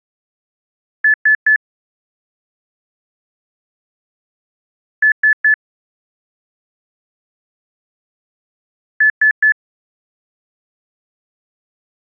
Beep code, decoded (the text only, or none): 3 short